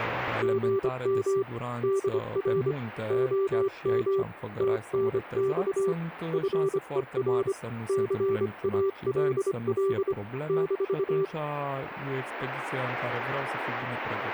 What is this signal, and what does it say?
Morse code, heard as a keyed tone, hand-sent with a paddle, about 25 wpm, 390 Hz. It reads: GM DR OM TNX FER CALL -